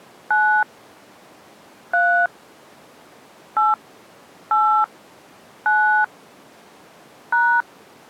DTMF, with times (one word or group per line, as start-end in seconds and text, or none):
0.3-0.6 9
1.9-2.3 3
3.6-3.7 8
4.5-4.8 8
5.7-6.0 9
7.3-7.6 #